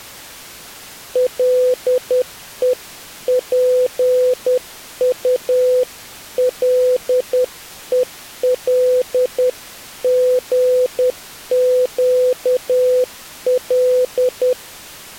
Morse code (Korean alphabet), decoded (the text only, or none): 가지각색